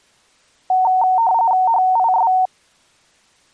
RTTY (45.45 baud, 170 Hz shift), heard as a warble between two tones, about 830 Hz centre. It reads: HIS